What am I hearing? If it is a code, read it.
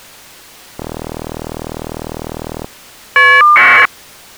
Caller ID data burst, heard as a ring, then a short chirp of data, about 1200 baud.